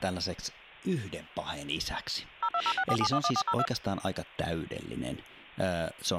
DTMF, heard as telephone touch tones, dialled by machine, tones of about 60 ms, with hum and speech in Finnish. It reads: 02064711402